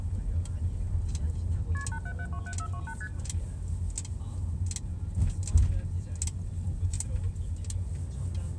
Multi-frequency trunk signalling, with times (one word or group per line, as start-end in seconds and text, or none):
1.7-1.8 KP
1.9-2.9 87727428
3.0-3.1 ST